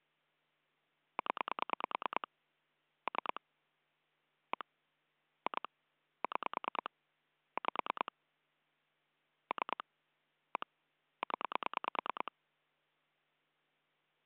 Pulse dialling, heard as clicks on a phone line, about 9 pulses a second. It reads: 0 3 1 2 6 5 3 1 0